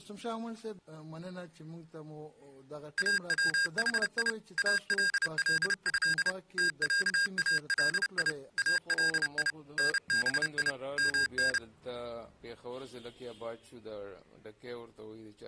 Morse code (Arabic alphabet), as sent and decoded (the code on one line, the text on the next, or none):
.- .-- .... .. / .- .-.. .-.. ..-.. / - .-.- .- .-.. .. / .- .-.. .. / -. -... .. / -- -.
اوحي الله تعالي الي نبي من